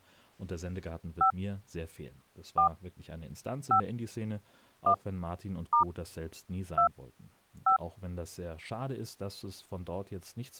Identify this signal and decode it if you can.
DTMF, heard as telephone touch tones, dialled by hand, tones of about 100 ms, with speech in German. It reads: 5 4 5 1 * 2 5